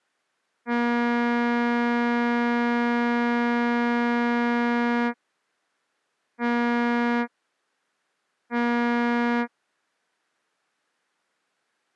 Ship horn signal, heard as a ship's horn, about 240 Hz. 1 long, 2 short. At sea: a vessel in fog that is sailing, fishing, towing or hampered.